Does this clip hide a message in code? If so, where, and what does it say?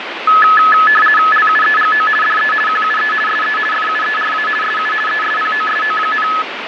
Yes: RTTY (50 baud, 450 Hz shift) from 0.3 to 6.4 s, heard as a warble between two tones, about 1500 Hz centre, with radio static and fading. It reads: LUEGO DE QUE SE FUERA SU ESPOSO,